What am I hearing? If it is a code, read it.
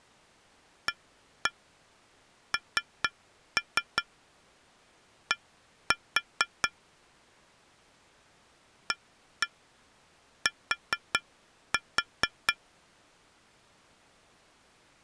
Tap code, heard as taps on glass, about 4 knocks a second. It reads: AND AT